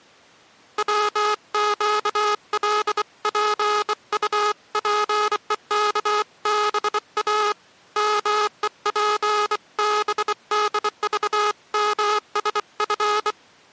Morse code (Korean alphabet), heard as a buzzer, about 24 wpm. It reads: 백지장도 맞들면